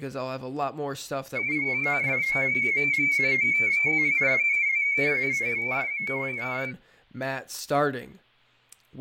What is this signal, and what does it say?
Multi-tone FSK (Olivia or MFSK type), about 250 Hz wide, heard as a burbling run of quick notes, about 31.25 baud, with fading and speech in English.